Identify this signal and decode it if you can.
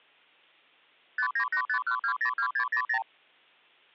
Multi-frequency trunk signalling (R2, with the far end's replies), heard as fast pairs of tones, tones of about 90 ms. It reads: 59851202600